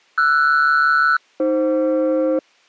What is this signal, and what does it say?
Aircraft SELCAL, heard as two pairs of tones. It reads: RS-AF